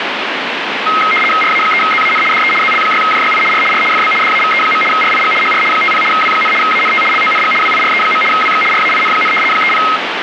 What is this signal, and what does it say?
RTTY (75 baud, 850 Hz shift), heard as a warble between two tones, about 1700 Hz centre, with radio static. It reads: RA3ZAN DE ZL6JYI R R FB DAVE. RIG HR 50 W, ANT LONG WIRE. WX RAIN, 30